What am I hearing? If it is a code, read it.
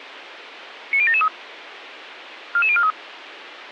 Five-tone selective call (ZVEI), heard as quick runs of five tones, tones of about 70 ms, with radio hiss. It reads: 90773 44043